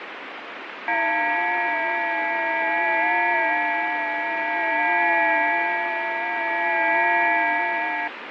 FT8 (several signals at once), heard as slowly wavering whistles, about 6.25 baud, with radio static.